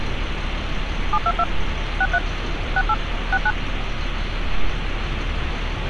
DTMF, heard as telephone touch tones, dialled by machine, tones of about 50 ms, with phone line noise and street noise. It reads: 722 63 68 69